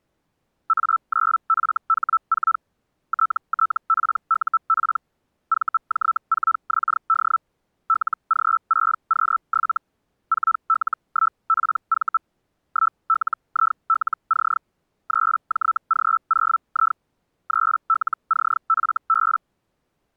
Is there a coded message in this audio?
Yes: Hellschreiber (Feld-Hell, 122.5 baud) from 0.7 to 19.4 s, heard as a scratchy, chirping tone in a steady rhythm, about 1320 Hz. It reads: A9FH4 TTPUP VJ4XD LG6Q7 4L1PV 1LILC 3JG0I 3LCFB